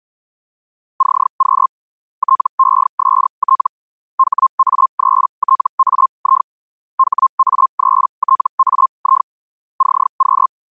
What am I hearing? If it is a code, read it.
Hellschreiber (Feld-Hell, 122.5 baud), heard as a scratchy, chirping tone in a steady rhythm, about 1060 Hz. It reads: CQ TEST HA3TAI HA3TAI CQ